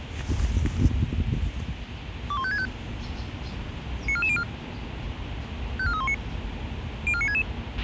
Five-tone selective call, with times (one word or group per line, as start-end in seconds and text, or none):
2.3-2.7 21565
4.1-4.4 94404
5.8-6.1 54319
7.1-7.4 04966